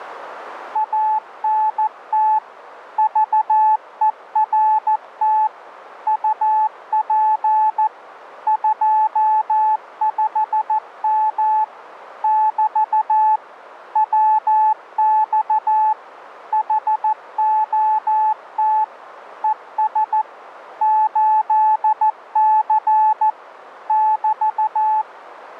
Morse code, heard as a keyed tone, machine-sent, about 14 wpm, 860 Hz. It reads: ANT VERT UP 25M <BT> WX HOT ES 8C <BT>